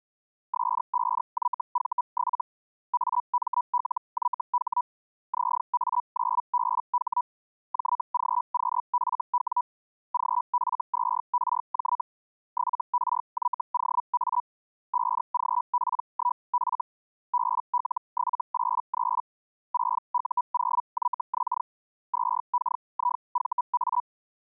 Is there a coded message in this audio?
Yes: Hellschreiber (Feld-Hell, 122.5 baud) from 0.5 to 24.0 s, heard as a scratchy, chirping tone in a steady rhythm, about 980 Hz. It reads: S5YV7 AMLYH ZA9BH JGQFW GF2RJ 7RYOA 5GP1F BL783 6U0YX 2KIVA